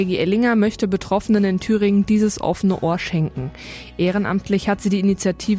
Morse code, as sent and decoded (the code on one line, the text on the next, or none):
none